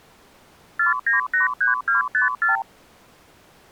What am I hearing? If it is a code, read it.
Multi-frequency trunk signalling (R2, with the far end's replies), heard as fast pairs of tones, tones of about 140 ms. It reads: 4983254